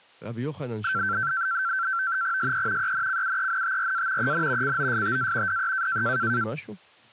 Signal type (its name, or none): NAVTEX (SITOR-B)